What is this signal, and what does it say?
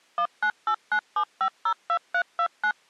DTMF, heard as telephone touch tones, dialled by machine, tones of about 80 ms. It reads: 19897502329